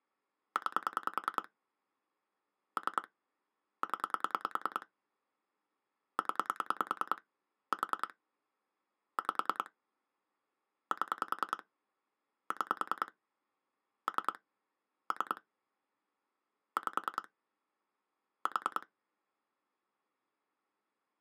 Pulse dialling, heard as clicks on a phone line, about 10 pulses a second. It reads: 9 3 0 0 4 5 7 6 3 3 5 4